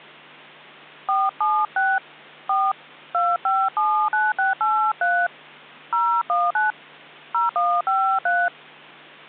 DTMF, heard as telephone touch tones, dialled by hand, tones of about 270 ms. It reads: 476 4 2579683 019 0153